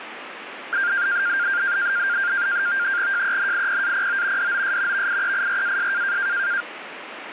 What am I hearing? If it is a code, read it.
NAVTEX (SITOR-B), 100 baud, 170 Hz shift, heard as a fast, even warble, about 1500 Hz centre, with radio static. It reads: JENIPAPO DOS VIEIRAS